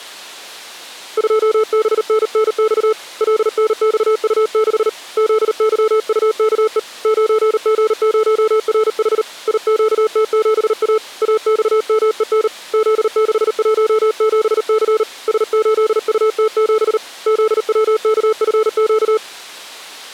Morse code, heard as a keyed tone, hand-sent with a paddle, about 38 wpm, 440 Hz. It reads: 2BNNX LNXU6 ZYUKE 9G0RH IQT7A AXMEN Z617C S8UT7 ZWKFQ